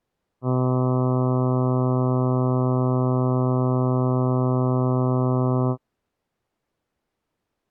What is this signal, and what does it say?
Ship horn signal, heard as a ship's horn, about 130 Hz. 1 long. At sea: a vessel nearing a blind bend, or under power and making way in fog.